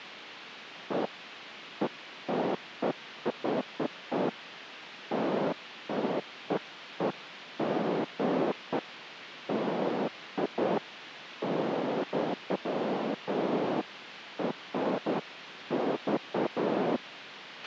Bursts of noise, with a squelch burst at the end. There is no code.